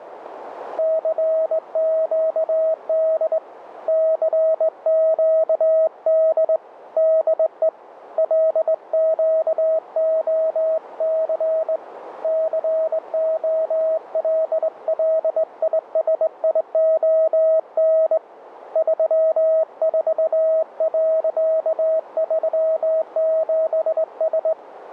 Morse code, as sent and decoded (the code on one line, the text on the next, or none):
-.-. --.- -.. / -.-. --.- -.. / -.. . / .-.. --.- --- -.-. / -.-. --- .-.. .-.. .. ... .. --- -. / ...-- ....- .-.-.- ...-- --... ...
CQD CQD DE LQOC COLLISION 34.37S